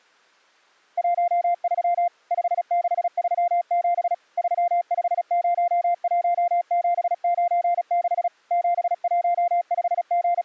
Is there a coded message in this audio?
Yes: Morse code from 0.9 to 10.4 s, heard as a keyed tone, machine-sent, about 36 wpm, 700 Hz. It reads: 13 5637 3501796 …